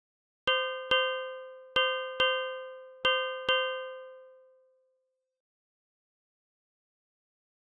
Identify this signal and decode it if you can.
Ship's bell, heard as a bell. 6. Six half-hours of the watch have passed.